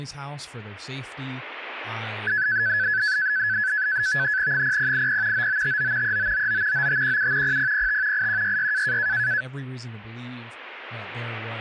NAVTEX (SITOR-B), 100 baud, 170 Hz shift, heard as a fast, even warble, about 1600 Hz centre, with speech in English. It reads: 0080 9959 3999 9517 0005 8166